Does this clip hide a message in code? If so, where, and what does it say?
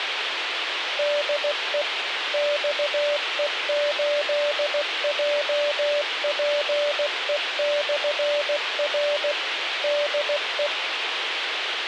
Yes: Morse code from 0.9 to 10.7 s, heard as a keyed tone, machine-sent, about 16 wpm, 580 Hz, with radio hiss. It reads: DE XE8JPE/R DE